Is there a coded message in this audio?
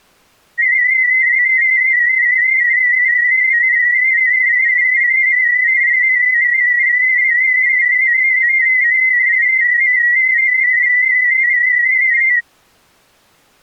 Yes: multi-tone FSK (Olivia or MFSK type), about 250 Hz wide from 0.6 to 12.4 s, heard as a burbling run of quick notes, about 31.25 baud.